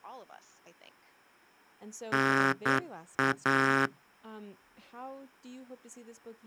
Morse code (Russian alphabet), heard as a buzzer, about 9 wpm, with speech in English. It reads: НА